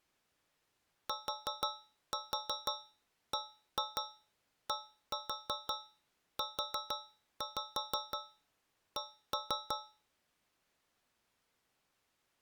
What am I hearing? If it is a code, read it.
Tap code, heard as taps on a metal pipe, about 6 knocks a second. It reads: TBDUC